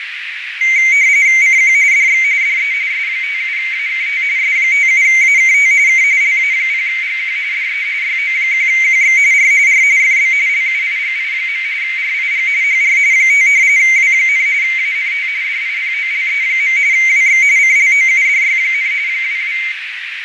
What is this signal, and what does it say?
RTTY (45.45 baud, 170 Hz shift), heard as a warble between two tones, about 2150 Hz centre, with radio static, fading and a narrow filter. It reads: CQ DX DE S57AKT S57AKT K LA0GQ DE YO1QX R R FB LUIGI. RIG HR 5 W, ANT DIPOLE. WX CLOUDY, 22